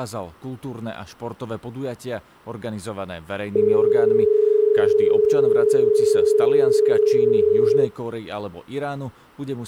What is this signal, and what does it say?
Telephone call progress tone (as in Australia), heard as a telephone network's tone, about 430 Hz, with speech in Slovak. Dial tone.